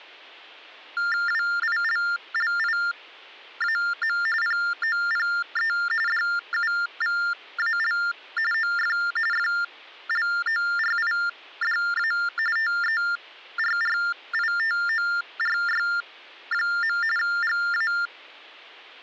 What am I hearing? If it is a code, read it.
TTY/TDD text telephone tones (45.45 baud Baudot), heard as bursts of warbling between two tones, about 400 Hz shift, 1600 Hz centre. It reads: WILLIAM POPE DUVAL OF FLORIDA TERRITORY. GA